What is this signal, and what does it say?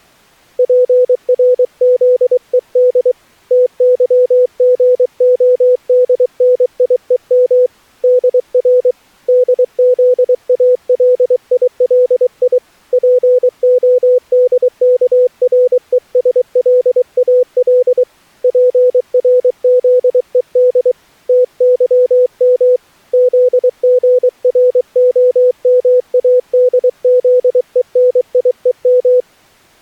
Morse code, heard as a keyed tone, hand-sent with a paddle, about 23 wpm, 500 Hz. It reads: PRZED TYGODNIEM DR DZALILI PODKRESLAL PRZED TYM ZGROMADZENIEM